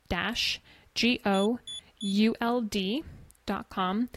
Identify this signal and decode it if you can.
Beep code, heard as a piezo beeper, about 3450 Hz, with speech in English. 3 short. In AMI BIOS tables: failure in the first 64 KB of memory; in Dell tables: chipset error.